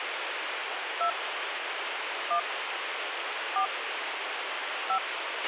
DTMF, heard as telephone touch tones, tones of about 80 ms, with radio hiss and a squelch burst at the end. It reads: 2 1 4 5